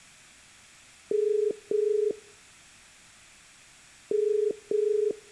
Telephone call progress tone (as in the UK, Ireland, Australia and similar networks), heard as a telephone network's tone, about 430 Hz, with room echo. Ringback tone.